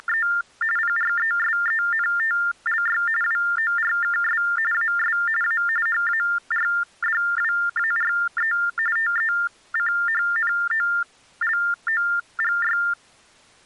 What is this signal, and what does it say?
TTY/TDD text telephone tones (45.45 baud Baudot), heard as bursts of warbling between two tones, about 400 Hz shift, 1600 Hz centre. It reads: … PRESENTLY WORKS AS A HARDWARE TECHNOLOGY